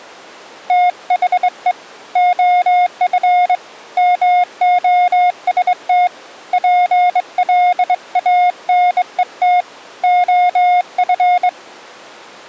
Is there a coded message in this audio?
Yes: Morse code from 0.6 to 11.5 s, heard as a keyed tone, hand-sent with a straight key, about 23 wpm, 720 Hz. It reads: THE OF MOST PLANET OF